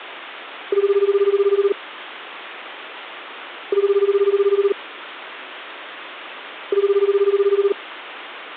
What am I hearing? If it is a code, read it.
Telephone call progress tone (Japanese plan), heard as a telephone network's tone, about 380, 400, 420 Hz, 1 s on and 2 s off. Ringback tone.